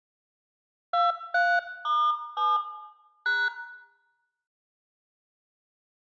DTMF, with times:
0.9-2.6 23*7
3.3-3.5 #

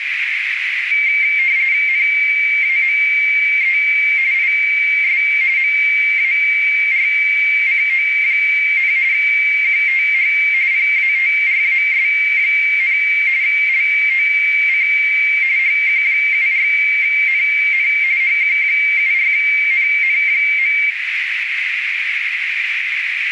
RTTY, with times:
1.9-3.8 NAME
4.3-5.2 IS
5.6-8.9 MARCO,
9.1-10.3 QTH
10.7-13.0 PATRAS,
13.4-14.9 LOC
15.6-17.9 HQ74NN
18.2-20.8 HQ74NN.

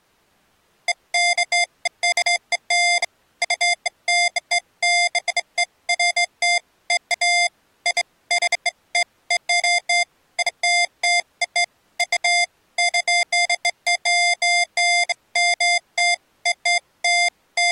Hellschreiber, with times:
none

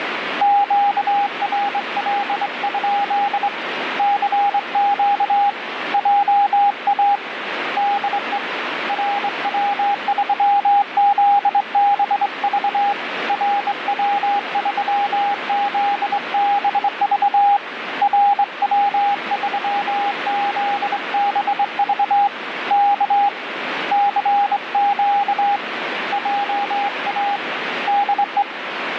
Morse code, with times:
0.4-3.5 QRL?
4.0-5.5 CQ
5.9-7.2 JA
7.8-8.4 DE
8.9-12.9 RW3ZBV
13.3-17.6 RW3ZBV
18.0-22.3 RW3ZBV
22.7-23.3 K
23.9-25.6 CQ
26.1-27.4 JA
27.9-28.4 DE

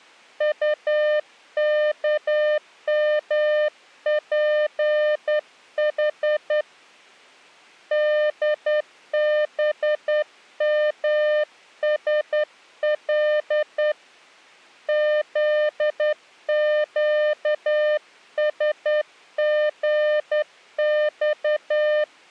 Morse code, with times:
0.4-6.6 UKMPH
7.9-13.9 DBMSL
14.9-22.0 ZQSGX

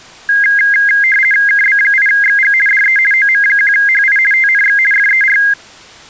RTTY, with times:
1.5-2.5 KB8XG
2.7-3.0 DE
3.1-4.2 OM1HI
4.3-4.8 TNX
4.9-5.4 FER

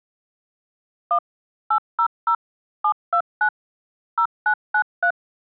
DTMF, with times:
1.1-1.2 1
1.7-2.3 800
2.8-3.5 729
4.2-5.1 0993

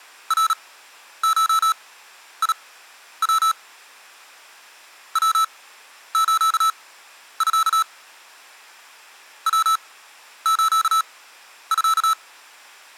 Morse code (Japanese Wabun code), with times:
0.3-3.5 ナゴヤ
5.2-7.8 ヤスミ
9.5-12.1 ヤスミ

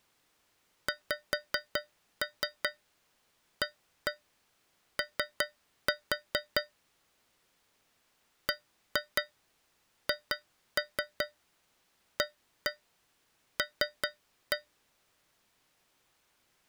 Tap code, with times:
0.9-6.6 XAO
8.5-14.6 BHAL

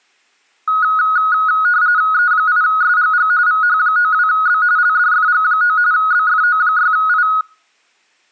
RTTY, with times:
2.1-3.3 E8SGG
3.5-4.6 VH92B
4.8-5.8 LDFG9
5.9-7.3 BFO6I

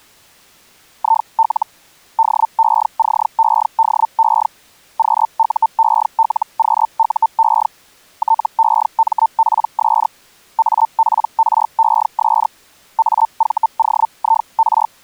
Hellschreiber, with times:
1.0-1.7 IL
2.2-4.5 DECEDE
5.0-7.7 QUELQUE
8.2-10.1 TEMPS
10.6-12.5 APRES
13.0-14.9 AVOIR

